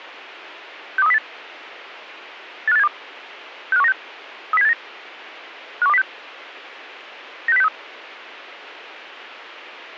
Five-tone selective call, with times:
1.0-1.2 62308
2.7-2.9 85872
3.7-3.9 65196
4.5-4.7 30789
5.8-6.0 51206
7.5-7.7 96063

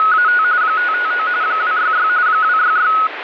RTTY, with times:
0.0-0.4 …
0.6-1.3 559
1.4-2.1 266
2.3-2.9 266

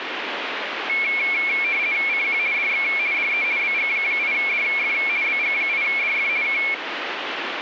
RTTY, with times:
2.1-2.4 CQ
2.5-2.8 DX
3.1-3.4 DE
3.6-4.9 BG8DF
5.2-6.3 BG8DF
6.4-6.6 K

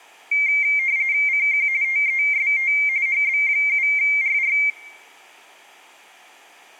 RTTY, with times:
1.3-1.7 CQ
1.8-2.7 TEST
3.1-4.6 HB7RR

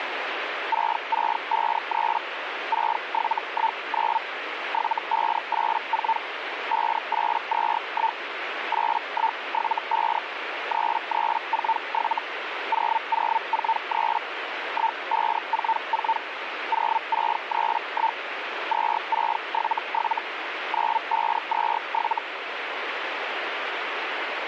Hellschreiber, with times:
0.7-2.2 6653
2.7-4.2 6719
4.7-6.2 7584
6.7-8.2 5821
8.7-10.2 8175
10.7-12.2 3347
12.7-14.2 0043
14.7-16.2 1544
16.7-18.2 0631
18.7-20.2 2677
20.7-22.2 9527

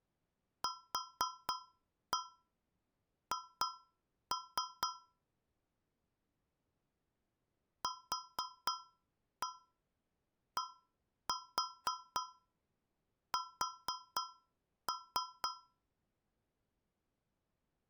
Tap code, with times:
0.6-4.9 QH
7.8-15.5 QDS

